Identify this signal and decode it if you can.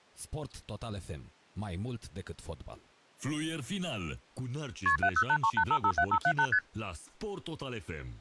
Multi-frequency trunk signalling (R1, as on North American trunks), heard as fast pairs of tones, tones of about 70 ms, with speech in Romanian. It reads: KP 70838557578 ST